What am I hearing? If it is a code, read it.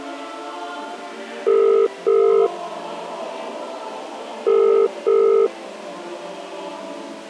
Telephone call progress tone (as in the UK, Ireland, Australia and similar networks), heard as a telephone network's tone, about 400, 450 Hz. Ringback tone.